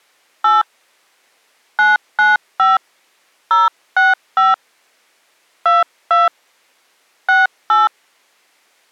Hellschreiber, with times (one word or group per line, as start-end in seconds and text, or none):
none